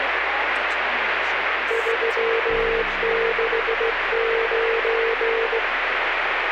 Morse code, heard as a keyed tone, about 16 wpm, 460 Hz, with radio static. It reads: 369